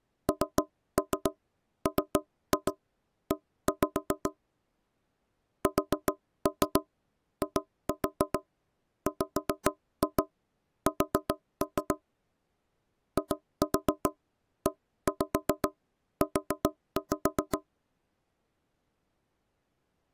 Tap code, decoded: NME SIWS IEU

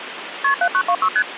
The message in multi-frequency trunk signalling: KP 7926 ST

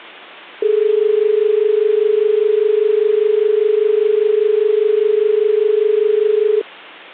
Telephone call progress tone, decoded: dial tone

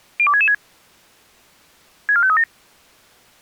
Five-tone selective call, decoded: 02666 64537

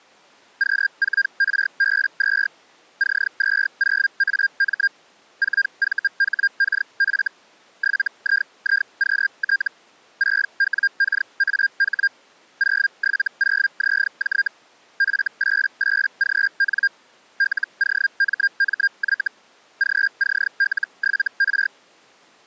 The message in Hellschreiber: Q4RB2 C20AM 4VHKF 7IIQT 6WKAH 070ZJ F88GN LOMMY GCL7R

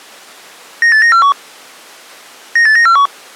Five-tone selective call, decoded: 98941 98941

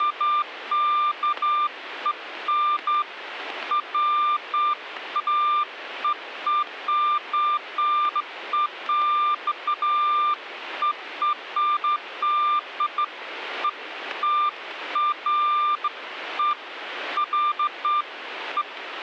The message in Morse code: none

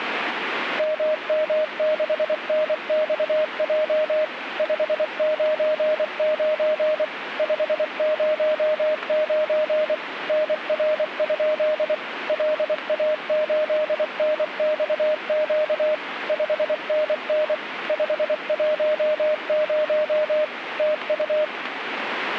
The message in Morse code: MM6NXJ 599 509 NR? LA8NXQ 5NN 510 TU

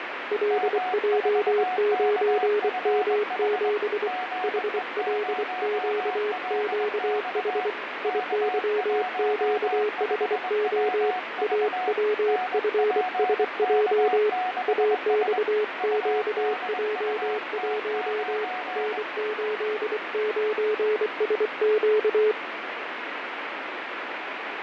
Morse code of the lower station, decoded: LJ9M7 HLQQH IYQHO AWFSJ AXQJ1 N89SQ

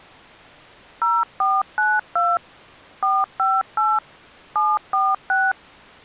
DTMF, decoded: 0492 458 746

